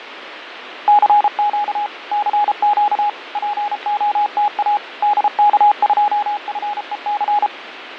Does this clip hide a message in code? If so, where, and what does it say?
Yes: Morse code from 0.8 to 7.5 s, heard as a keyed tone, machine-sent, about 33 wpm, 830 Hz, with radio static and fading. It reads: CQ CQ POTA DK2FEC